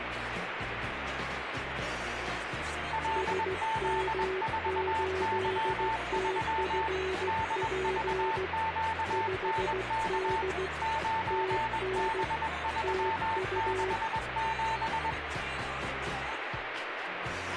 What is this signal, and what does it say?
Morse code, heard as two keyed tones, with radio static. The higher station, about 21 wpm, 890 Hz: LZ4Y3 DVQNK 9B367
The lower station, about 16 wpm, 380 Hz: SM8TFP 5D TN TU